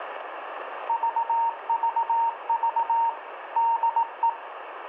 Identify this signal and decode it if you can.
Morse code, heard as a keyed tone, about 18 wpm, 920 Hz, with radio static and room echo. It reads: VVV DE